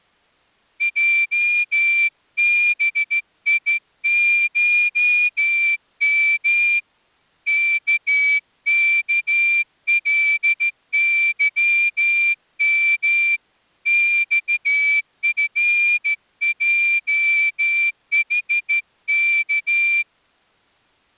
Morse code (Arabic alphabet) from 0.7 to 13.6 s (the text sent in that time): جبيشم ككلظم